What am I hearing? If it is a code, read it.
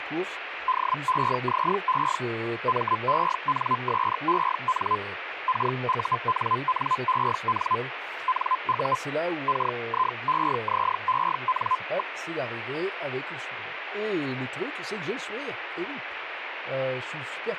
Hellschreiber (Feld-Hell, 122.5 baud), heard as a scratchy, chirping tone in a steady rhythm, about 1020 Hz, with radio static and speech in French. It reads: DEZE MENSEN KUNNEN NU KIEZEN.